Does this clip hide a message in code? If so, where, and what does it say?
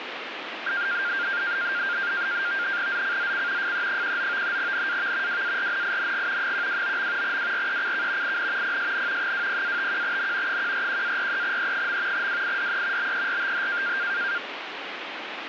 Yes: NAVTEX (SITOR-B), 100 baud, 170 Hz shift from 0.7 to 14.4 s, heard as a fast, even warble, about 1500 Hz centre, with radio static. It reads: ZCZC FE19 NAV WARNING 129. WRECK IN PSN 20-51N 141-43E. WIDE BERTH